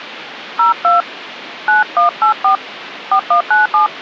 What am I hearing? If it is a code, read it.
DTMF, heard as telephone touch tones, dialled by hand, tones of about 120 ms, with phone line noise. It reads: 02 9184 4197